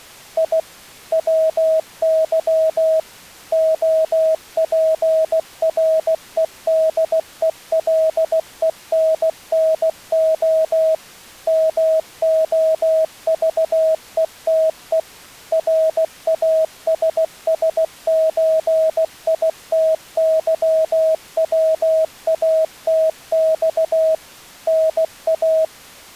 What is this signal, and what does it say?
Morse code (Russian alphabet), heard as a keyed tone, machine-sent, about 16 wpm, 640 Hz. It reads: И ВЫ ОПРЕДЕЛЕННО МОЖЕТЕ РАССЧИТЫВАТЬ НА